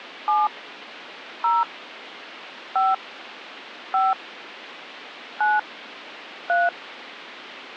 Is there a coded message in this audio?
Yes: DTMF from 0.3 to 6.7 s, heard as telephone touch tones, dialled by hand, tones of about 190 ms. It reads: 7 0 5 5 9 3